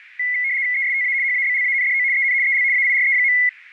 RTTY (75 baud, 170 Hz shift), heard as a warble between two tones, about 2050 Hz centre, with radio static and a narrow filter. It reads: ESTA HABLANDO EN EL AIRE.